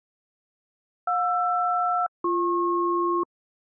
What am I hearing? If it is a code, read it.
Aircraft SELCAL, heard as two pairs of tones. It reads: JR-BP